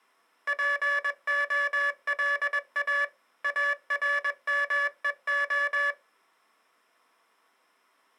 Morse code, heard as a buzzer, machine-sent, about 21 wpm. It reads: POLA ARMEO